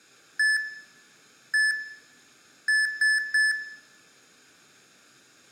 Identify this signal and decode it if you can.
Beep code, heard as beeps from a small speaker, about 1750 Hz, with room echo. 1-1-3. In Phoenix BIOS tables: CMOS read or write failure.